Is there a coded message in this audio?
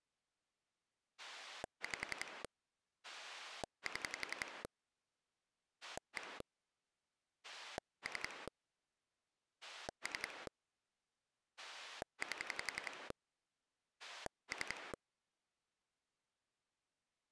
Yes: pulse dialling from 1.2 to 14.9 s, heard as a rotary dial, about 11 pulses a second. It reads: 5 7 1 3 3 8 3